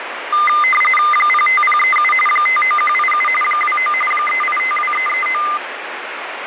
RTTY (45.45 baud, 850 Hz shift), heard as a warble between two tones, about 1650 Hz centre, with radio static. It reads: 05037 59187 29 3852339